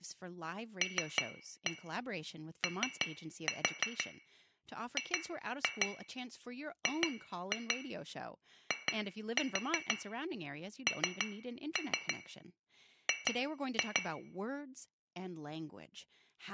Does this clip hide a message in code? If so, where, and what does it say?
Yes: tap code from 0.8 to 14.1 s, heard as taps on glass, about 6 knocks a second, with room echo and speech in English. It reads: LOGGING